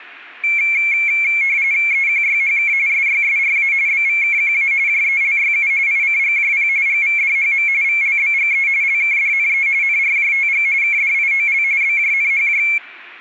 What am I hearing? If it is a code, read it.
RTTY (45.45 baud, 170 Hz shift), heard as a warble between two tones, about 2250 Hz centre, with room echo. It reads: EQYHK SYSRA BVKQA JELYU ICGJP GVDHM VLBGE LKDNE NRJTG KDIOL BJNHJ